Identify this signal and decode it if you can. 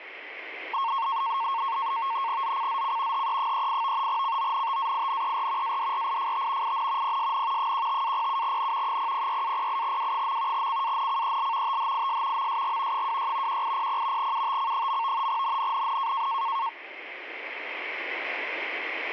NAVTEX (SITOR-B), 100 baud, 170 Hz shift, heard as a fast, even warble, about 1000 Hz centre. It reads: ZCZC HE38 CONTAINER ADRIFT IN PSN 15-07N 006-08W. CANCEL THIS MSG 26 1800 UTC. NNNN